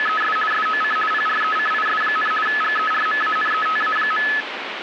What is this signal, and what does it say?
RTTY (50 baud, 450 Hz shift), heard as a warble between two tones, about 1500 Hz centre, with radio static. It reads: … SOC PRECIS, GERMANETA.